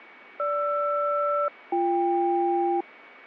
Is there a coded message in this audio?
Yes: aircraft SELCAL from 0.4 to 2.8 s, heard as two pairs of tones, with radio static and a steady whistle near 2250 Hz. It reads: GR-BK